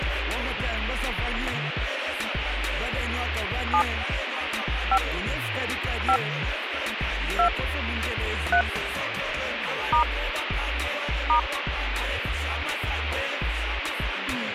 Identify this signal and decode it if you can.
DTMF, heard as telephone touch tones, dialled by hand, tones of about 80 ms, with radio hiss. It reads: 7 5 5 2 3 * *